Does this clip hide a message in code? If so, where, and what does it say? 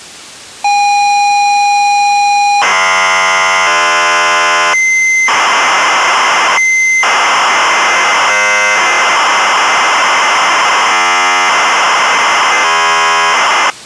Yes: ZX Spectrum tape loading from 0.6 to 13.7 s, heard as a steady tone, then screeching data.